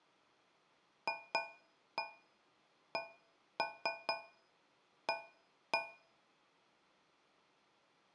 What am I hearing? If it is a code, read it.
Tap code, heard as taps on a metal pipe, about 4 knocks a second, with room echo. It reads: FCA